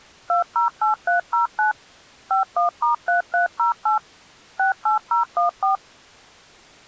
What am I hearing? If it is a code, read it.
DTMF, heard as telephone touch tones, dialled by machine, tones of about 130 ms. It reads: 208309 51*3308 68014